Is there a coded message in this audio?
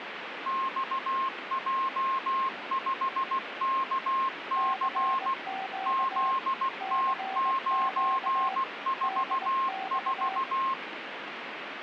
Yes: Morse code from 0.4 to 10.8 s, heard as two keyed tones, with radio static. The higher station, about 16 wpm, 1070 Hz: XJ5KC ZT944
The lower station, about 20 wpm, 770 Hz: CQ CQ DX